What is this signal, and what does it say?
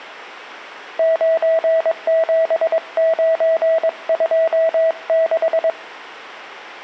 Morse code, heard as a keyed tone, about 22 wpm, 650 Hz, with room echo. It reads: 97926